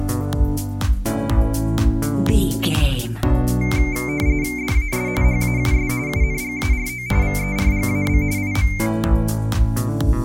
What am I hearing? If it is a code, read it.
RTTY (45.45 baud, 170 Hz shift), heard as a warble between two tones, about 2200 Hz centre. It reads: DAS HAUS UNGARO VERGAB IM